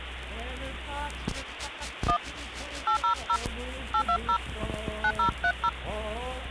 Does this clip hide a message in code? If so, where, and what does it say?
Yes: DTMF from 2.1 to 5.7 s, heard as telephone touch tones, dialled by hand, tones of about 80 ms, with phone line noise. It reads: 1 800 820 9030